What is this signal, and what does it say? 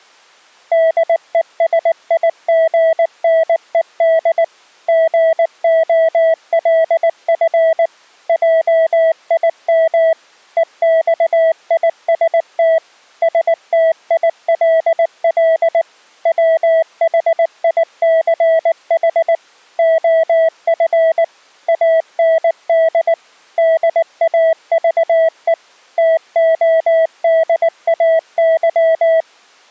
Morse code, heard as a keyed tone, machine-sent, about 19 wpm, 650 Hz. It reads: DESIGNED GOLF JIM EXIST STILL WHICH OF AND DAVE TODAY